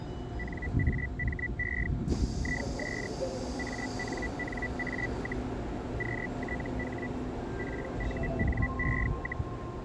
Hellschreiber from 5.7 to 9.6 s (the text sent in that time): QTH PUNE,